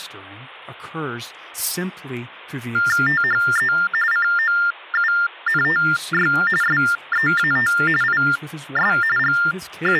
TTY/TDD text telephone tones (45.45 baud Baudot), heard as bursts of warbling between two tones, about 400 Hz shift, 1600 Hz centre, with speech in English. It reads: THE COUNTY SEAT IS …